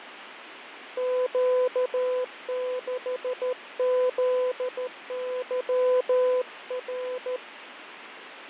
Morse code, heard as a keyed tone, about 13 wpm, 500 Hz, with radio static and fading. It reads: Q6ZYR